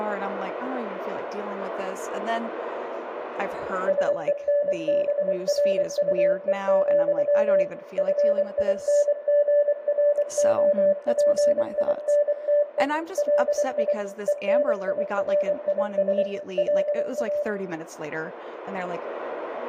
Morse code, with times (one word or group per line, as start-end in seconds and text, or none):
3.9-7.6 SENBRUE,
8.0-12.8 FINGROPINTE
13.2-13.9 LI
14.3-16.2 ENIRIS
16.6-17.4 LA